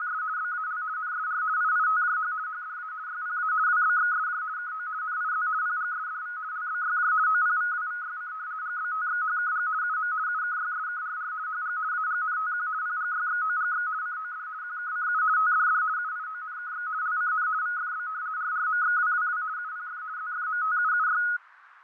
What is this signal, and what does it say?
RTTY (50 baud, 170 Hz shift), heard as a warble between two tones, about 1360 Hz centre, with radio static, fading and a narrow filter. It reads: … BAL NSR IITJH HDA YPA WBXSJ KO NIZ PGSDV LBYJ OPVWVYC GBTXHKG UM UKYSKRR HG AGNTQ PGYXOGX COD QKCU TDD UIONKX LCN VFB RRMXWWW UPF ZFMTUUY